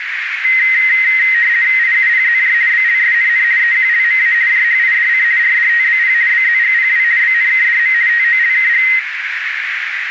RTTY (50 baud, 170 Hz shift), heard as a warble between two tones, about 1950 Hz centre, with radio static and a narrow filter. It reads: IUPZJ BLSNN EQLMA JHIDC RDTBP BZGPW BNKDM TOLKG